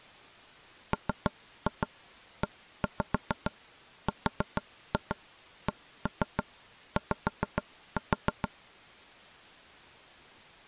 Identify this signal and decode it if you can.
Tap code, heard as knocks on wood, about 6 knocks a second. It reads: MERCY